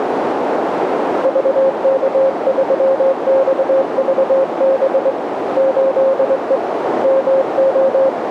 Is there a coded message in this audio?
Yes: Morse code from 1.2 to 8.2 s, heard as a keyed tone, hand-sent with a straight key, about 22 wpm, 540 Hz, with radio static and a narrow filter. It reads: VK3XVB 8E MO